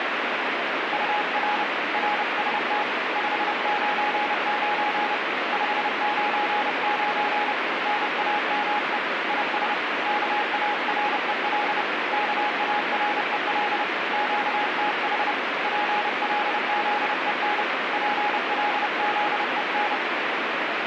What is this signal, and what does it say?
Morse code, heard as a keyed tone, hand-sent with a paddle, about 30 wpm, 830 Hz, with heavy radio static. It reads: UR RST 599 599 NAME IS KAREL KAREL QTH PLZEN PLZEN